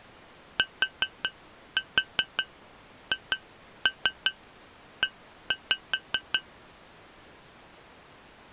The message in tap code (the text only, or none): THE